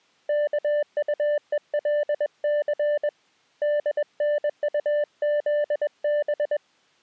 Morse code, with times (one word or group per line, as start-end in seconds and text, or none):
0.3-3.1 KUELC
3.6-6.6 DNUZB